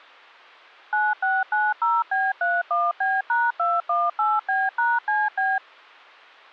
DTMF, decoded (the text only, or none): 9690B31B#218B#CB